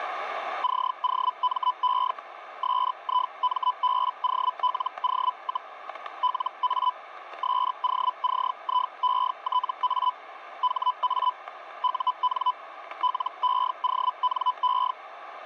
Hellschreiber (Feld-Hell, 122.5 baud), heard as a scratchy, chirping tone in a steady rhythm, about 1000 Hz, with static crashes. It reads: COME SIMBOLO, LA SOCIETA HA UN LEONE